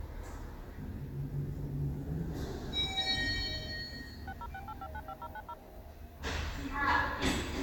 DTMF, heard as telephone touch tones, dialled by machine, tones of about 50 ms, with the noise inside a lift. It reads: 6068595090